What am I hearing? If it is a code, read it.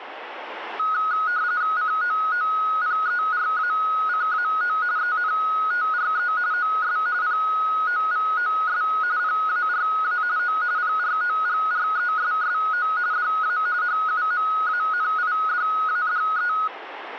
RTTY (45.45 baud, 170 Hz shift), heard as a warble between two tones, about 1360 Hz centre, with radio static. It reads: COOPERACAO ENTRE OS POVOS PARA O PROGRESSO DA HUMANIDADE